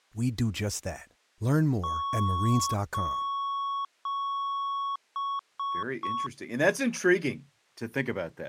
Beep code, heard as beeps, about 1110 Hz, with speech in English. 3 long, 3 short.